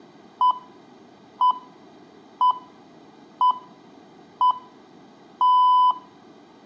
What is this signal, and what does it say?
Radio time signal (six pips, as the Greenwich Time Signal), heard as pips, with room echo.